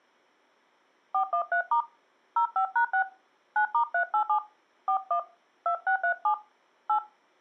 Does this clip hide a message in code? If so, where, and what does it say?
Yes: DTMF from 1.1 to 7.0 s, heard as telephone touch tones, dialled by hand, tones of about 90 ms. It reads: 413* 05#6 9*387 41 2637 8